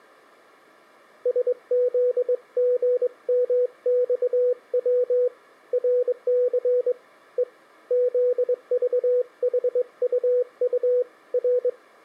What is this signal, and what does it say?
Morse code, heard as a keyed tone, hand-sent with a straight key, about 22 wpm, 500 Hz. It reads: SZGMXW RC E ZVHUU R